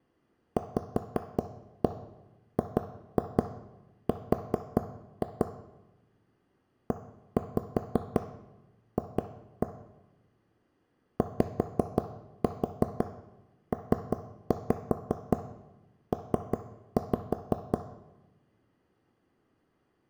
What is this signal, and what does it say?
Tap code, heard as taps on a table, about 5 knocks a second, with room echo. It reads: VGR EF YPP